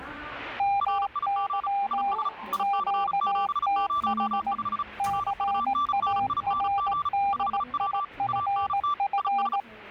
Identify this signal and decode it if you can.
Morse code, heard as two keyed tones, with the noise inside a lift. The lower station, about 18 wpm, 800 Hz: MY QTH CARDIFF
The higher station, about 35 wpm, 1170 Hz: RIG IS IC705 RUNNING 5W ANT IS